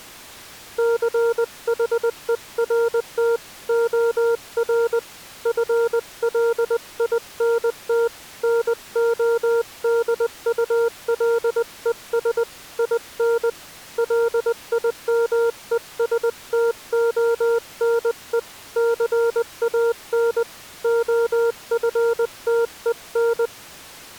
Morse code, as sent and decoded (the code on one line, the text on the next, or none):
-.-. .... . .-. - / --- .-. / ..-. .-.. .. -. - / -. --- -.. ..- .-.. . ... / .. -. / .-.. .. -- . ... - --- -. . / -.-. .- -. / --- ..-. - . -.
CHERT OR FLINT NODULES IN LIMESTONE CAN OFTEN